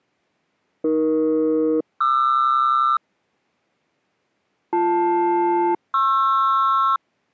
Aircraft SELCAL, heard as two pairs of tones. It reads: AE-QR BL-PR